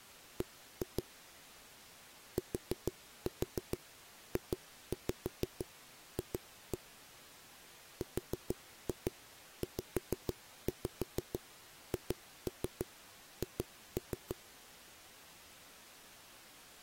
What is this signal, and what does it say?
Tap code, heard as knocks on a wall, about 6 knocks a second. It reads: B TJF RZHH